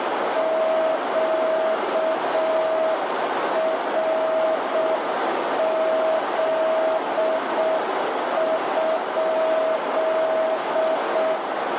Morse code, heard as a keyed tone, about 6 wpm, 640 Hz, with heavy radio static and a narrow filter. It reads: QRZ?